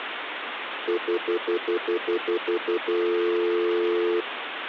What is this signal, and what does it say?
Telephone call progress tone (North American plan), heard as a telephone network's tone, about 350, 440 Hz, 0.1 s on and 0.1 s off, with phone line noise. Stutter dial tone.